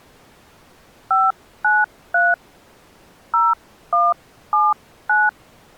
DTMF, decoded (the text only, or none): 593 0179